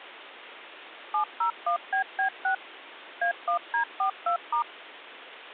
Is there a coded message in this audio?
Yes: DTMF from 1.1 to 4.6 s, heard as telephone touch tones, dialled by machine, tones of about 100 ms. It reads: 701BB6 A1D42*